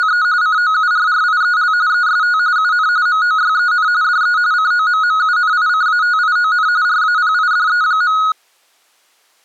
RTTY (45.45 baud, 170 Hz shift), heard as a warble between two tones, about 1360 Hz centre. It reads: … COURRIEL EST UN MOYEN DE COMMUNICATION RAPIDE.